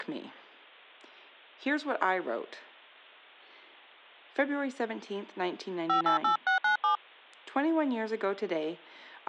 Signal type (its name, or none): DTMF